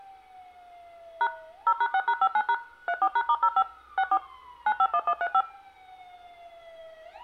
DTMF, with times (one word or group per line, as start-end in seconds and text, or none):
1.2-1.3 #
1.7-2.5 0#6#59#
2.9-3.6 34#*05
4.0-4.2 64
4.7-5.4 951135